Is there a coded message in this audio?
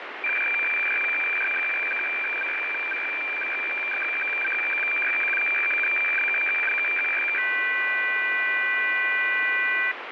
Yes: weather fax (radiofax), 120 lines a minute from 0.2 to 9.9 s, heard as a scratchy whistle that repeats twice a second, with radio static.